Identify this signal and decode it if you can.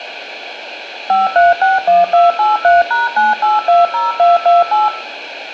DTMF, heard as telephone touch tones, dialled by machine, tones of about 170 ms, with radio hiss, a squelch burst at the end and room echo. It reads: 5361283#9820228